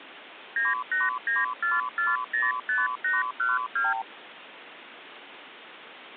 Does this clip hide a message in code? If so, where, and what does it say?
Yes: multi-frequency trunk signalling (R2, with the far end's replies) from 0.6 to 4.0 s, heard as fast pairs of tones, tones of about 180 ms, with phone line noise. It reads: 9894405812